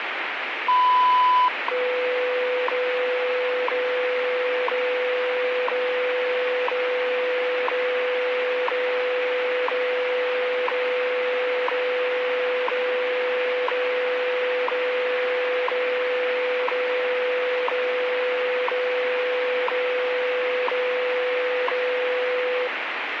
Radio time signal (WWV, Colorado), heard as ticks, one a second, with radio static.